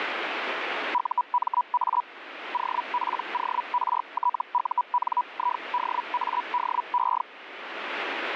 Hellschreiber (Feld-Hell, 122.5 baud), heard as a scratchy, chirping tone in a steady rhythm, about 980 Hz, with radio static. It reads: UMA OPORTUNIDADE